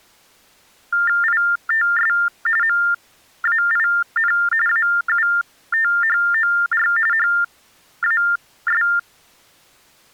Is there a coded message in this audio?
Yes: TTY/TDD text telephone tones (45.45 baud Baudot) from 0.9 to 9.0 s, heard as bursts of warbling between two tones, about 400 Hz shift, 1600 Hz centre. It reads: ITS MAIN AUTHOR HAS